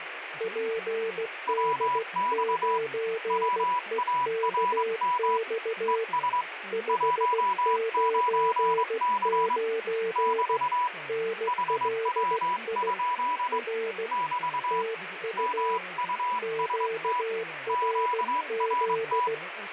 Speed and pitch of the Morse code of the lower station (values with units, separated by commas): 16 wpm, 450 Hz